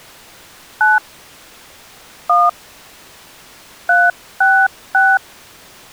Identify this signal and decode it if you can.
DTMF, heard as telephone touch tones, dialled by hand, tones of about 220 ms. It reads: 9 1 366